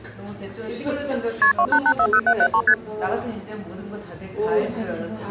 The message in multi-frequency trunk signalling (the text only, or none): KP 28840773 ST